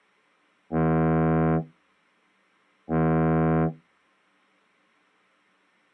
Ship horn signal, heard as a ship's horn, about 80 Hz. 2 short. At sea: I am altering course to port.